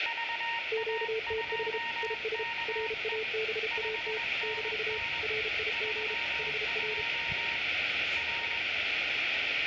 Morse code, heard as two keyed tones, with radio static, room echo and the noise of a residential street. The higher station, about 21 wpm, 930 Hz: VA2KE 5NN 32 R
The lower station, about 33 wpm, 440 Hz: QTH IS RABAT - RIG HR